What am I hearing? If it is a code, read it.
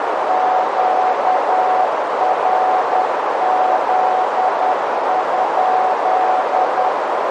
Morse code, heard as a keyed tone, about 10 wpm, 740 Hz, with heavy radio static and a narrow filter. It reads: QRZ?